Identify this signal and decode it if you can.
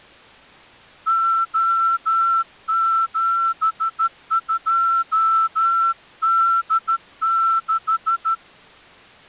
Morse code, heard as a whistle, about 13 wpm. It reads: O72D6